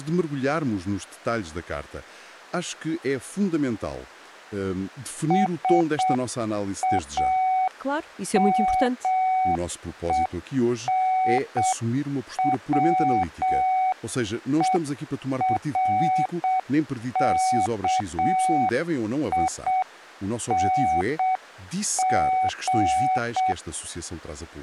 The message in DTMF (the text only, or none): none